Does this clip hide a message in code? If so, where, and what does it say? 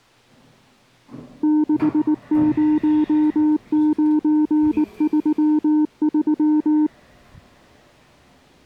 Yes: Morse code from 1.4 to 6.9 s, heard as a keyed tone, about 19 wpm, 300 Hz, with the noise inside a lift. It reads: 60933